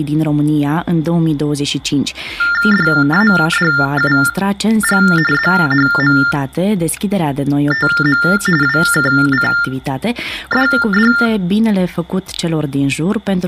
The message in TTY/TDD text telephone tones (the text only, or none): DADUG ZHMTM WKCDD